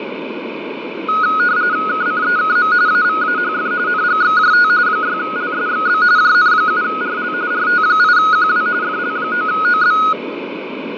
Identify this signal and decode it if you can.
RTTY (45.45 baud, 170 Hz shift), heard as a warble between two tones, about 1360 Hz centre, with radio static and fading. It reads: KCEKM AVAHF NGXJT 6LSXB JN7RL RT8QW FL9OB